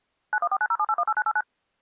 DTMF, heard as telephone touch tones, dialled by machine, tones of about 50 ms. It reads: 914907818989